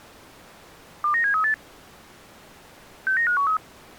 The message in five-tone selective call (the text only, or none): 29738 69513